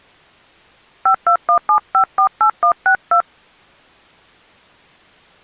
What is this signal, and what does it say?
DTMF, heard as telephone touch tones, dialled by hand, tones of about 90 ms. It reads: 5217548162